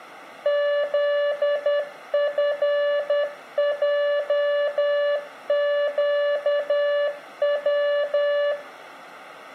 Morse code, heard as a keyed tone, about 10 wpm, 580 Hz, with room echo. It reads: ZFJQW